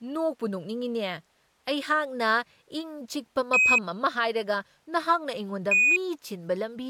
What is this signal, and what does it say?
Quindar tones, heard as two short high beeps, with speech in Manipuri.